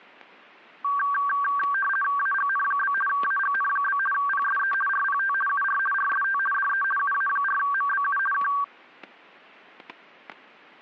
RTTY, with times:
2.2-2.9 AGN?
3.1-4.0 AGN?
4.1-4.7 PSE
4.9-5.3 RPT
5.5-5.8 UR
5.9-6.4 RST
6.5-6.8 DE
7.0-8.2 UA4MBU
8.3-8.5 K

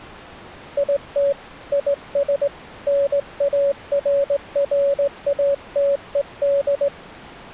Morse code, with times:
0.8-1.3 IT
1.7-2.5 IS
2.9-6.9 NARRATED

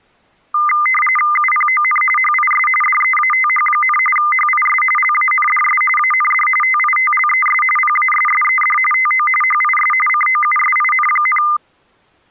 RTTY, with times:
1.4-2.0 UPON
2.2-2.7 HIS
2.8-4.0 DEATH,
4.2-4.8 HIS
5.0-5.8 LANDS
6.0-6.5 AND
6.6-7.6 TITLES
7.8-8.8 PASSED
8.9-9.3 TO
9.4-9.9 HIS
10.1-11.4 COUSIN,

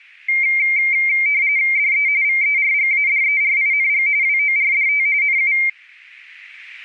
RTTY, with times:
1.8-2.1 DE
2.2-4.1 VERGADERING
4.2-5.1 WORDT
5.2-5.5 NU

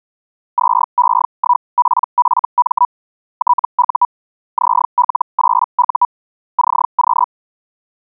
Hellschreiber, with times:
0.6-2.9 2E1PFM
3.4-4.1 TU
4.6-6.1 ZL8U
6.6-7.3 CQ

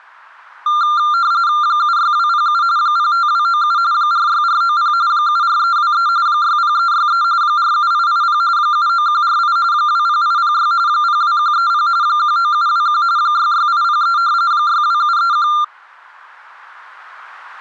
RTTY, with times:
1.6-2.6 76207
2.8-3.8 05297
3.9-4.9 46490
5.1-6.1 74323
6.3-7.2 60363
7.4-8.4 47880
8.6-9.6 79148
9.7-10.7 20806
10.9-11.9 02130
12.0-13.0 19721
13.2-14.2 66803
14.5-15.5 62731

